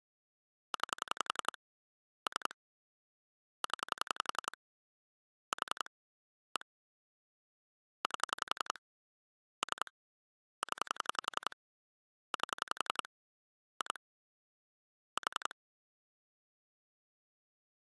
Pulse dialling, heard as clicks on a phone line, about 11 pulses a second. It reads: 9 3 0 4 1 8 3 0 8 2 4